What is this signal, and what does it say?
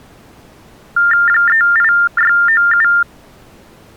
TTY/TDD text telephone tones (45.45 baud Baudot), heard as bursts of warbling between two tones, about 400 Hz shift, 1600 Hz centre. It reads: 38697